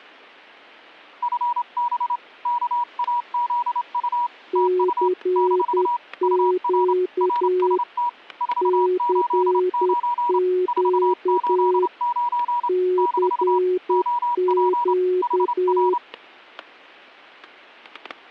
Morse code, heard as two keyed tones, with static crashes. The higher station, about 28 wpm, 960 Hz: FB KAZU TU - UR RST 489 489 - OP HR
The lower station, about 10 wpm, 360 Hz: CQ CQ CQ